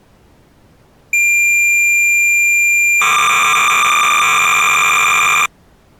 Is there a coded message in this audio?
Yes: cassette data (Kansas City type), 300 baud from 1.1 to 5.5 s, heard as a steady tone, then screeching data.